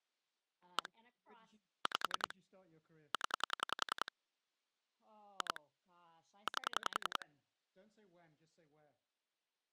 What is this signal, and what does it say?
Pulse dialling, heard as clicks on a phone line, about 10 pulses a second, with speech in English. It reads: 1 5 0 2 8